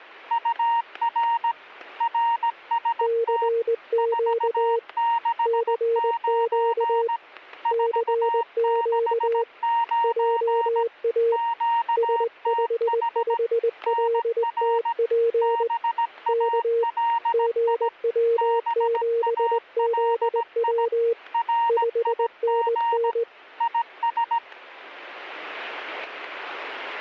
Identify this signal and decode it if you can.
Morse code, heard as two keyed tones, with static crashes. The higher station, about 17 wpm, 930 Hz: UR RST 469 469 QTH NR BALI BALI RIG IS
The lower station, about 20 wpm, 460 Hz: CQ CQ CQ JA S55LTP K GW7ZW 5NN